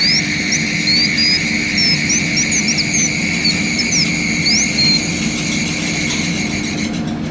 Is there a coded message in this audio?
No, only bird-like chirps.